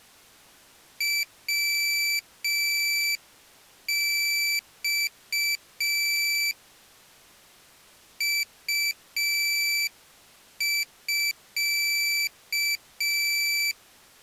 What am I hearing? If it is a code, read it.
Morse code (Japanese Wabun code), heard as a high beeper, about 5 wpm, 2300 Hz. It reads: ヤマ ウミ